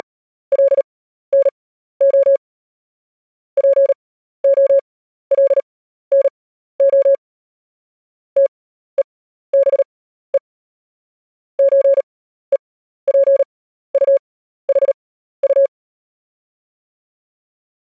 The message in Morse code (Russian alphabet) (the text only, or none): … ПОЛНО ТЕБЕ ЧЕПУХУ